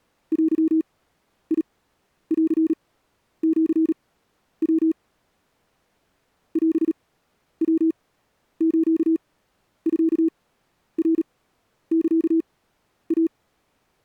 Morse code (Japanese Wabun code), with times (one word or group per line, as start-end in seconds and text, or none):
0.3-4.9 デンシヤ
6.6-13.3 オヤスミナサイ